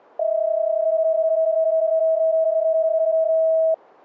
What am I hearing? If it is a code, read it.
PSK31 (31.25 baud), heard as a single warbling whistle, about 640 Hz.